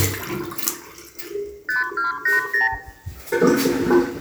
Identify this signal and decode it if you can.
Multi-frequency trunk signalling (R2, with the far end's replies), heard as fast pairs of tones, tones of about 140 ms, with room echo and the noise of a restroom. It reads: 5280